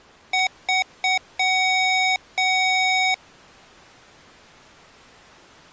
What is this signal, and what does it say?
Beep code, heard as beeps from a small speaker, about 750 Hz. 3 short, 2 long.